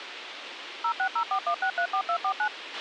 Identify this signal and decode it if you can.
DTMF, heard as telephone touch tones, dialled by machine, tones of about 80 ms, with radio hiss and a squelch burst at the end. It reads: 06041634249